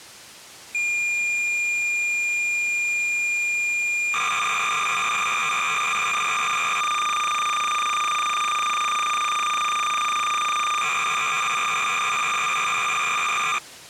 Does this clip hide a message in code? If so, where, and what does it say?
Yes: cassette data (Kansas City type), 300 baud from 0.7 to 13.6 s, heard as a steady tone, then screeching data.